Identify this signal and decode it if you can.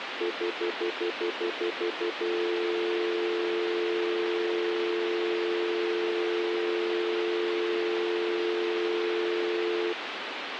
Telephone call progress tone (North American plan), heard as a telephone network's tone, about 350, 440 Hz, 0.1 s on and 0.1 s off, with phone line noise. Stutter dial tone.